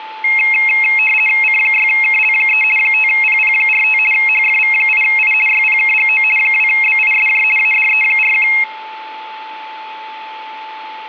RTTY (50 baud, 450 Hz shift), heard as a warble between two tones, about 2350 Hz centre, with a steady whistle near 870 Hz. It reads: C6KL3 5PP45 HFV8I YPKGO 2BISJ ADE41